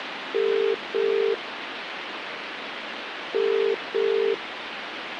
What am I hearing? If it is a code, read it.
Telephone call progress tone (as in the UK, Ireland, Australia and similar networks), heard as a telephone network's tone, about 400, 450 Hz, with phone line noise. Ringback tone.